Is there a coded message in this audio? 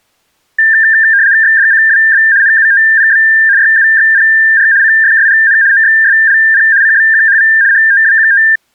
Yes: RTTY (75 baud, 170 Hz shift) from 0.6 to 8.6 s, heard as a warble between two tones, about 1700 Hz centre. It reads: XDCWB NUTPB YUXPR CFSGN OXSLP CBQHV HTWQT